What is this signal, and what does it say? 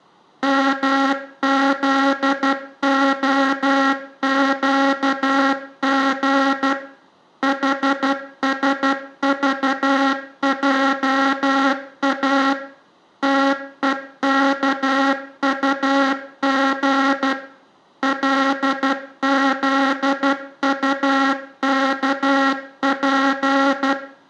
Morse code, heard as a buzzer, machine-sent, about 12 wpm, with room echo. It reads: MZOQG HSVJA TEKUG LZUKP